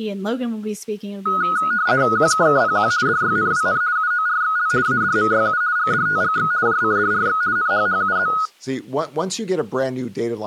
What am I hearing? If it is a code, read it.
RTTY (50 baud, 170 Hz shift), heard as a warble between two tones, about 1360 Hz centre, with speech in English. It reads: QKKPQ DYNWN UORXL ADMYU GDTGX JCDRX NHHUZ